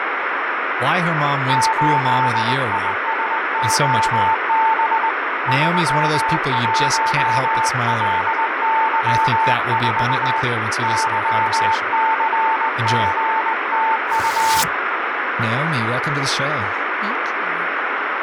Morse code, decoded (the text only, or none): 8ISOB 31LY4 YCGTU